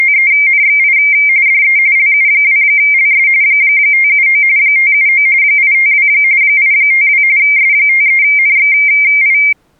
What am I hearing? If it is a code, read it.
RTTY (45.45 baud, 170 Hz shift), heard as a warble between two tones, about 2200 Hz centre. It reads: … DE LU2LS 579 579 852 852 S53NXI